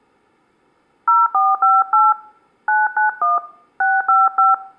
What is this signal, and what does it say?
DTMF, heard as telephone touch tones, dialled by hand, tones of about 180 ms. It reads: 0458 991 655